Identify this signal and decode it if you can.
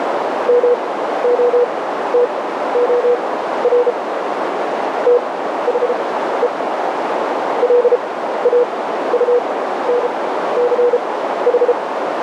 Morse code, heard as a keyed tone, machine-sent, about 33 wpm, spaced as for 14 wpm, 490 Hz, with heavy radio static and a narrow filter. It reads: MOTOR THE LAUNCH